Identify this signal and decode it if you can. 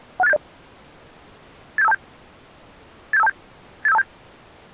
Five-tone selective call (EIA), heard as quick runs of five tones, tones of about 30 ms. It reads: 16870 87527 87527 87527